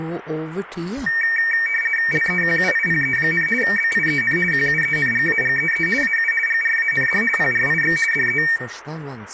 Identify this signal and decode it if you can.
RTTY (50 baud, 450 Hz shift), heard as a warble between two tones, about 2050 Hz centre, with room echo. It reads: LEQUIPE, BIEN QUENGAGEE AU GRAND PRIX DE